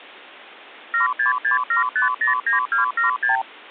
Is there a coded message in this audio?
Yes: multi-frequency trunk signalling (R2, with the far end's replies) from 0.9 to 3.4 s, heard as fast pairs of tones, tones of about 130 ms. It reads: 7667509276